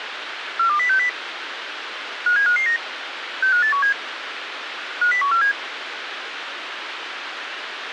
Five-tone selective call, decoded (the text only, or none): 42060 57559 65817 50147